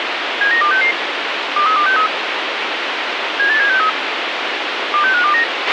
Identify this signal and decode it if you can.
Five-tone selective call (CCIR), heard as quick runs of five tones, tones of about 100 ms, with radio hiss and a squelch burst at the end. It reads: 79266 23263 78763 26529